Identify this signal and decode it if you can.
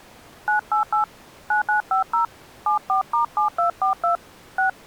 DTMF, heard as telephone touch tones, dialled by hand, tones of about 120 ms. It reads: 988 9950 74*7242 6